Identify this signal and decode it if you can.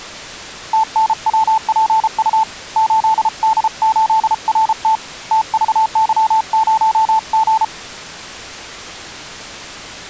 Morse code, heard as a keyed tone, hand-sent with a paddle, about 33 wpm, 880 Hz. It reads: TNWPU 8D8RT TVY0G